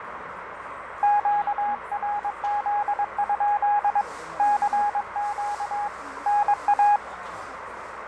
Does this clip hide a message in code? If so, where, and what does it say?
Yes: Morse code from 1.0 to 7.0 s, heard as a keyed tone, hand-sent with a paddle, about 22 wpm, 830 Hz, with radio static, fading, a narrow filter and the noise of a restaurant. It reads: QRZ? CQ NA